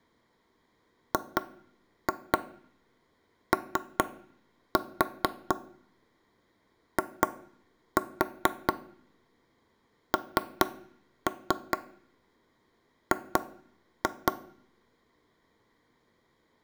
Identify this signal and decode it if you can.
Tap code, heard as knocks on wood, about 4 knocks a second, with room echo. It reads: GOING